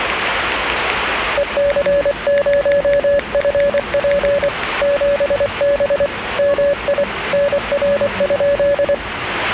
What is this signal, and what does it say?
Morse code, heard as a keyed tone, hand-sent with a paddle, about 24 wpm, 570 Hz, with radio static and the noise of a cafe. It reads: EC0FP 7B MI NR?